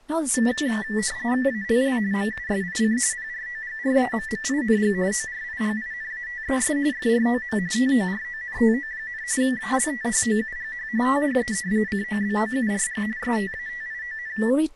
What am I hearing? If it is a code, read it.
RTTY (45.45 baud, 170 Hz shift), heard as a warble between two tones, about 1850 Hz centre, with speech in English. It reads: ALL MUSIC PROGRAMMING ORIGINATES FROM TORONTO, ALTHOUGH THE COBOURG STATION